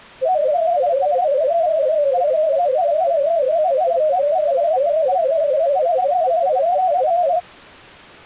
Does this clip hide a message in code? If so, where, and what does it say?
Yes: multi-tone FSK (Olivia or MFSK type), about 250 Hz wide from 0.2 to 7.4 s, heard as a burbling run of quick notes, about 31.25 baud.